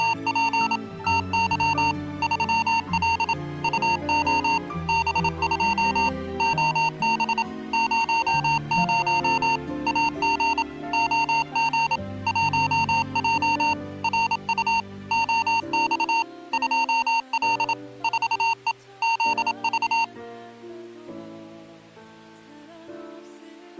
Morse code, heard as electronic beeps, machine-sent, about 27 wpm, 920 Hz. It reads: … TY 3L UO B2 OB 00 AG OG 1J RU OX 2L 4E ZV